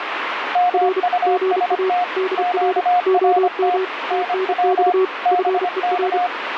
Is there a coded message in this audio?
Yes: Morse code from 0.5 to 6.3 s, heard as two keyed tones, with radio static. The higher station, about 25 wpm, 720 Hz: MUST QRT NW BK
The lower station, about 32 wpm, 380 Hz: R GA DR OM TNX FER